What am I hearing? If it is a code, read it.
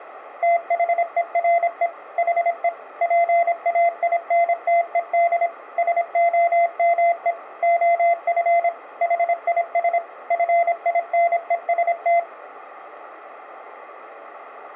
Morse code, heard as a keyed tone, machine-sent, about 26 wpm, 690 Hz. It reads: THERE HE PAINTED SOME OF HIS FINEST